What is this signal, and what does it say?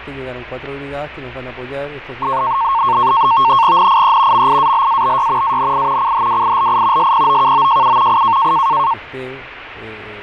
NAVTEX (SITOR-B), 100 baud, 170 Hz shift, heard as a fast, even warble, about 1000 Hz centre, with radio static and fading. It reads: NIE MIALABY ANI CHWILI SPOKOJU I